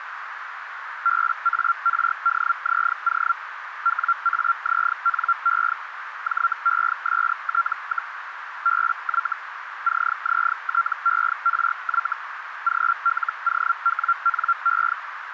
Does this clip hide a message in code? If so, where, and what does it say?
Yes: Hellschreiber (Feld-Hell, 122.5 baud) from 1.0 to 14.9 s, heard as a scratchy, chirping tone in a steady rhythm, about 1370 Hz, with radio static and a narrow filter. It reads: BARDZO WAZNE JEST, BY CZTERY GLOWNE